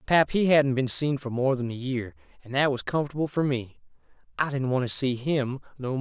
Speech in English. There is no code.